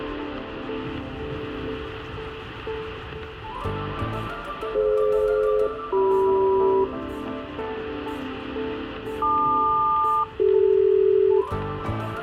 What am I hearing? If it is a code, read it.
Aircraft SELCAL, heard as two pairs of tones, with room echo. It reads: DF-CM LQ-CD